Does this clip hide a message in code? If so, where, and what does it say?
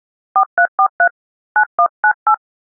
Yes: DTMF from 0.4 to 2.3 s, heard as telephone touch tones, dialled by hand, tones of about 80 ms. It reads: 4343 9198